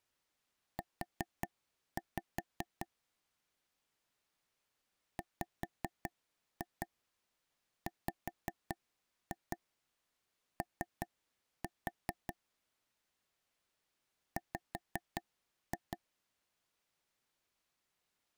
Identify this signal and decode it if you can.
Tap code, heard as taps on a table, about 5 knocks a second. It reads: U WWO W